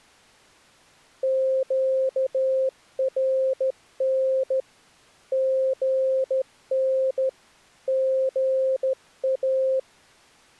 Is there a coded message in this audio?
Yes: Morse code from 1.2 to 9.9 s, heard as a keyed tone, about 14 wpm, 530 Hz. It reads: QRN GN GA